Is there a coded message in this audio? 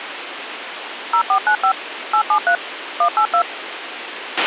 Yes: DTMF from 1.1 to 3.4 s, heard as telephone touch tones, dialled by machine, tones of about 80 ms, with radio hiss and a squelch burst at the end. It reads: 0495 873 182